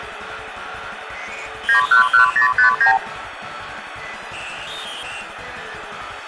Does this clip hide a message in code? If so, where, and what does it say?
Yes: multi-frequency trunk signalling (R2, with the far end's replies) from 1.7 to 3.0 s, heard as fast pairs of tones, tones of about 110 ms, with phone line noise. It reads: 911059